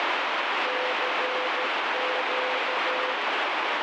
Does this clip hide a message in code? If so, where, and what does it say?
Yes: Morse code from 0.6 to 3.2 s, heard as a keyed tone, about 13 wpm, 510 Hz, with heavy radio static. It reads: CQ